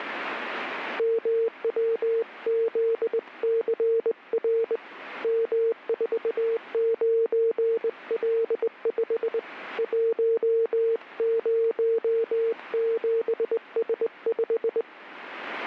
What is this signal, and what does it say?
Morse code, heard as a keyed tone, hand-sent with a straight key, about 20 wpm, 460 Hz. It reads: MWZCR M49L5 107S5